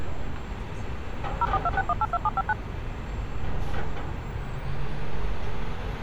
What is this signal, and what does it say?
DTMF, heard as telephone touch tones, dialled by machine, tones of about 40 ms, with street noise. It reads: 0426182759